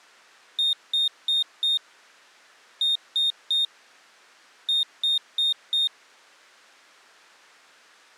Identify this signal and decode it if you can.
Beep code, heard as a piezo beeper, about 3700 Hz. 4-3-4. In Phoenix BIOS tables: time-of-day clock failure.